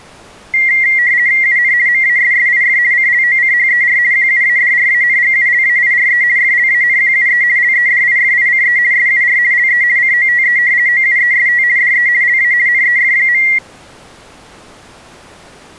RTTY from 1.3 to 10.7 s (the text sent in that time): UN MASSIF CLOCHER QUADRANGULAIRE FLANQUE LEDIFICE SUR LE COTE